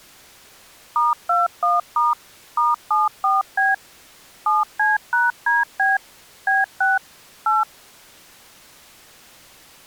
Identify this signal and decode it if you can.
DTMF, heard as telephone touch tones, dialled by machine, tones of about 170 ms. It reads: *21* *74B 7C#DB B6 8